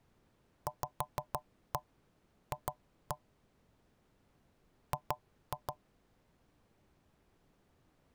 Tap code, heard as knocks on wood, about 6 knocks a second. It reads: VF G